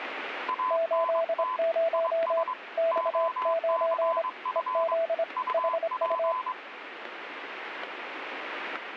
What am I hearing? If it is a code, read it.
Morse code, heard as two keyed tones, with radio static and static crashes. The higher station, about 23 wpm, 1020 Hz: ANT IS OCF UP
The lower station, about 26 wpm, 660 Hz: 80 X9 EZ HU